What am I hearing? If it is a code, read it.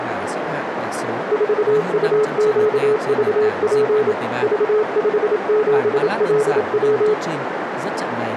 Morse code, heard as a keyed tone, machine-sent, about 27 wpm, 430 Hz, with radio static, a narrow filter and speech in Vietnamese. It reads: 4UQVP V57LW